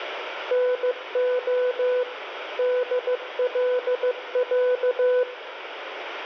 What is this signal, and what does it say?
Morse code (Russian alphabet), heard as a keyed tone, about 15 wpm, 500 Hz, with radio static. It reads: НО ДЛЯ